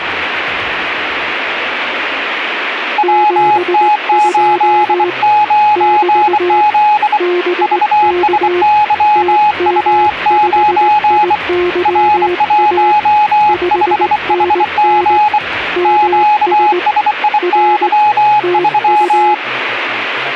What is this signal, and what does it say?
Morse code, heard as two keyed tones, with radio static. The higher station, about 24 wpm, 840 Hz: WT89Z VSYU9 R15HG QSIY3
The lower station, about 19 wpm, 360 Hz: 72 <BT> BK TM5IYA 5NN MS R TU